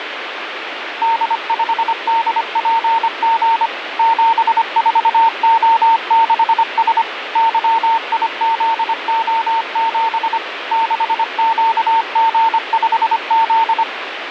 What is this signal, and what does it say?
Morse code, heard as a keyed tone, machine-sent, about 25 wpm, 910 Hz, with radio static. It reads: D5DPG 74O6S YIZO7 6QG5Z